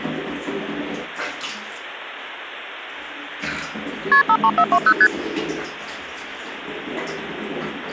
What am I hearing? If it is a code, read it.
Multi-frequency trunk signalling (R1, as on North American trunks), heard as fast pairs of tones, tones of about 60 ms, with the noise of a restroom. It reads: KP 53420 ST